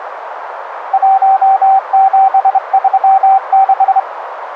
Morse code, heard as a keyed tone, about 25 wpm, 770 Hz, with radio static and a narrow filter. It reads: 1736